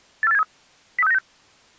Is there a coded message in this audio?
Yes: five-tone selective call (EEA) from 0.2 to 1.2 s, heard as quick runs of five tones, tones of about 40 ms. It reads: 84873 03696